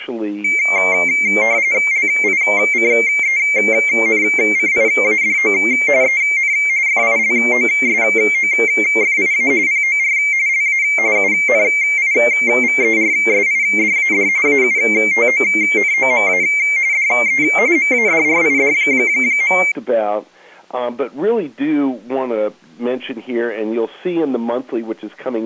RTTY (45.45 baud, 170 Hz shift), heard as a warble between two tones, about 2200 Hz centre. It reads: LICENCIADO EN FILOSOFIA POR LA UNIVERSIDAD AUTONOMA DE MADRID.